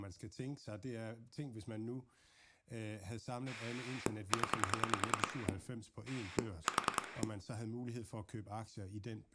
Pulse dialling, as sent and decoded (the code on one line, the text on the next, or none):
10 / 4
0 4